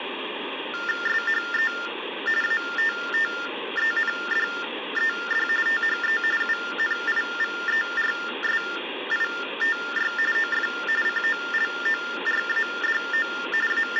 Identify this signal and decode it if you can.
TTY/TDD text telephone tones (45.45 baud Baudot), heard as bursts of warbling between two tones, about 400 Hz shift, 1600 Hz centre, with phone line noise. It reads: SHE ATTENDED THE UNIVERSITY OF COLORADO …